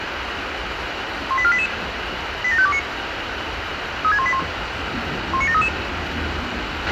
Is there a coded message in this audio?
Yes: five-tone selective call (ZVEI) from 1.3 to 5.7 s, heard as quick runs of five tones, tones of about 70 ms, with radio hiss, a squelch burst at the end, room echo and the noise of a park. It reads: 18488 87529 36181 19733